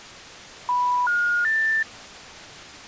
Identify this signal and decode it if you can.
Telephone call progress tone (North American plan), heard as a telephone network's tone, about 980, 1430, 1800 Hz. Special information tone.